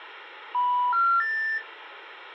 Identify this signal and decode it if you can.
Telephone call progress tone (North American plan), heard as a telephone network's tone, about 980, 1370, 1800 Hz, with phone line noise. Special information tone.